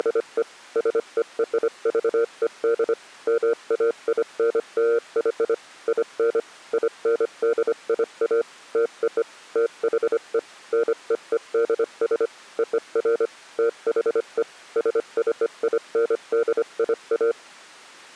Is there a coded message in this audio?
Yes: Morse code (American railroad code) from 0.0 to 17.4 s, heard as a keyed tone, machine-sent, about 470 Hz. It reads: … SERVED MAINLY IN INDIA TO THE NEEDS OF THE SCINDIA